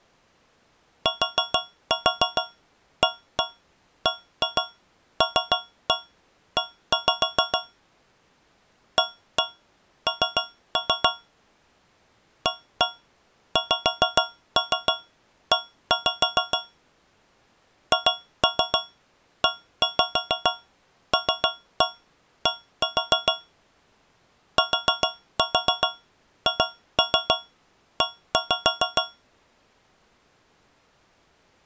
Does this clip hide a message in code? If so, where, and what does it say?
Yes: tap code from 1.1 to 29.3 s, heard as taps on a metal pipe, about 6 knocks a second. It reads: TABLE AN AXE HELD THE